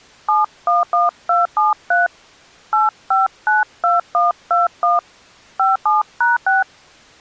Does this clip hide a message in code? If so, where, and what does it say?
Yes: DTMF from 0.3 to 6.6 s, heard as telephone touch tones, dialled by hand, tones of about 160 ms. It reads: 711273 8592121 57#6